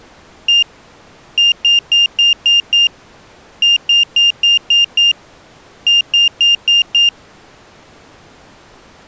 Beep code, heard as a piezo beeper, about 2800 Hz. 1-6-6-5.